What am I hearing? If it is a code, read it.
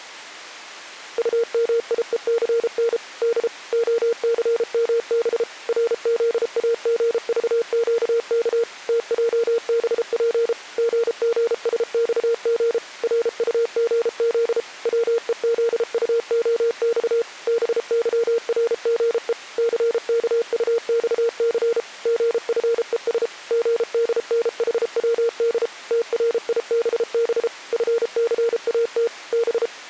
Morse code, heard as a keyed tone, machine-sent, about 33 wpm, 460 Hz. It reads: UMIECN D OCMB RZAGVQK TJBP GGSXG RUGZ WEZUOX BYRGE CKUXC GFES GDNHWD TRIBB FCAT B